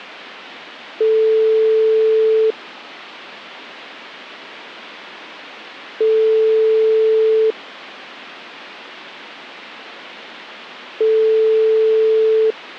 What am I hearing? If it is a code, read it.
Telephone call progress tone (single-tone plan, as in most of Europe), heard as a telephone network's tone, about 440 Hz, 1.5 s on and 3.5 s off. Ringback tone.